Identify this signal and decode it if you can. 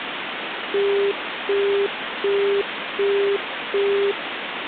Telephone call progress tone (as in the UK, Australia and similar networks), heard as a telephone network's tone, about 400 Hz, 0.375 s on and 0.375 s off, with phone line noise. Busy tone.